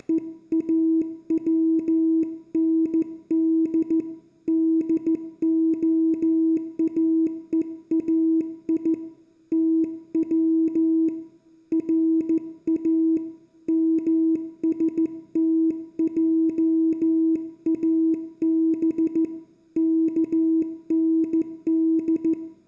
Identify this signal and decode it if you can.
Morse code (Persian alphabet), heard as a keyed tone, hand-sent with a straight key, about 14 wpm, 320 Hz, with room echo. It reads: … دعاهای تو را مستجاب کند